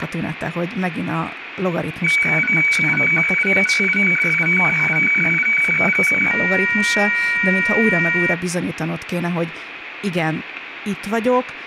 Weather fax (radiofax), 120 lines a minute, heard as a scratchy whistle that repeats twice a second, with radio static and speech in Hungarian.